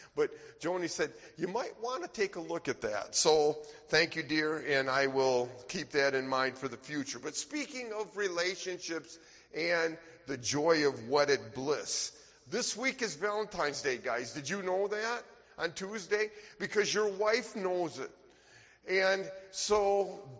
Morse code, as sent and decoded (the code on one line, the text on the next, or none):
none